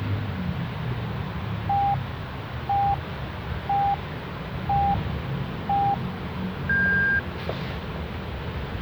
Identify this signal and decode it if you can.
Radio time signal (five pips and a higher one, as on Chinese radio), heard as pips, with a squelch burst at the end and the noise of a residential street.